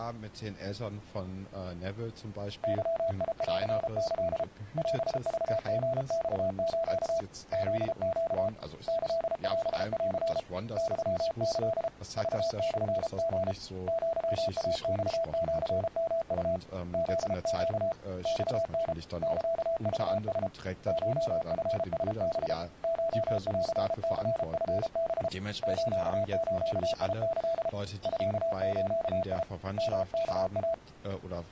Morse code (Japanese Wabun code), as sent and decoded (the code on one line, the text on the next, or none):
-.-- .. .-.-. -.-.. / .-... ...- --. -..- ---.- / --.. --.- / -.-.. .-... .-.-. / -..-- -.-.. / ...- -..-. --. / --.-- .- -..- --.-. -- ..- / --.. --.- / -..- -. / -.-.- ...- ... / ---- ..-. ... -... / ---- .-.-. -.-. ..-. -... / ---.- ---.- .. -.-.. / ..-.- ---.- .. / -- -.- .-
ゲンキ オクリマス フネ キオン ユキ クモリ アイマシヨウ フネ マタ サクラ コチラハ コンニチハ スズキ ミズ ヨワイ